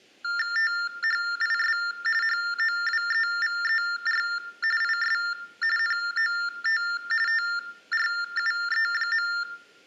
TTY/TDD text telephone tones (45.45 baud Baudot), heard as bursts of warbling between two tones, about 400 Hz shift, 1600 Hz centre, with room echo. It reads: THIS HOWEVER IS NOT TRUE.